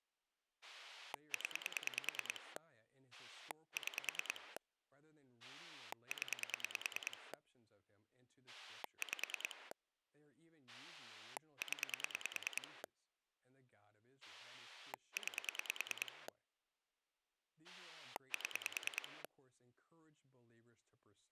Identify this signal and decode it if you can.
Pulse dialling, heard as a rotary dial, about 9 pulses a second, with speech in English. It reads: 0 6 0 5 0 9 7